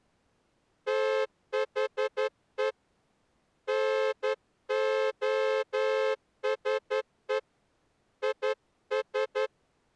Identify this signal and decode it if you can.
Morse code, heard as a horn, hand-sent with a straight key, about 11 wpm. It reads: THE NOSE IS